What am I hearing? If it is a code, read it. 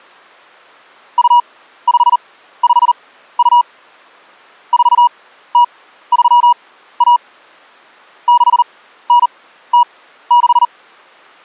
Morse code (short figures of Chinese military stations), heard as a keyed tone, machine-sent, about 39 wpm, spaced as for 15 wpm, 960 Hz. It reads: 2552 4031 6906